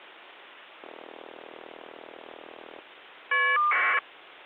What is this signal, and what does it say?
Caller ID data burst, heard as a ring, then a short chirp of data, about 1200 baud.